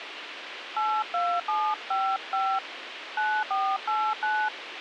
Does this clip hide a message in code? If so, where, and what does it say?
Yes: DTMF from 0.8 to 4.5 s, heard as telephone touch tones, dialled by hand, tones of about 260 ms, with radio hiss. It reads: 82755 9489